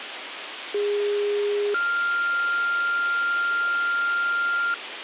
Two-tone page, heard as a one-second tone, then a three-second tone, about 410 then 1400 Hz, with radio hiss.